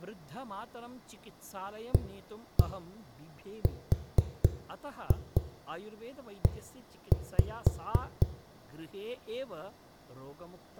Tap code, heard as knocks on a wall, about 4 knocks a second, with room echo and speech in Sanskrit. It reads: ARE